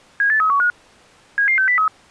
Five-tone selective call (CCIR), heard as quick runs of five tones, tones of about 100 ms. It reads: 78315 77603